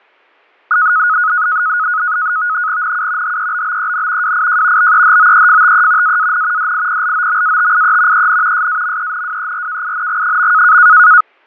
NAVTEX (SITOR-B), 100 baud, 170 Hz shift, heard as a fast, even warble, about 1360 Hz centre, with fading and static crashes. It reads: NU HEBBEN WIJ BEHOEFTE AAN DIPLOMATIE EN SAMENWERKING.